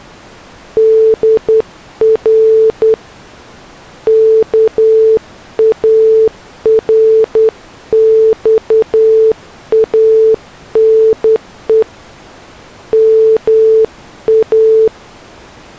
Morse code (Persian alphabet), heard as a keyed tone, hand-sent with a straight key, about 10 wpm, 440 Hz. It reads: در کارخانه ما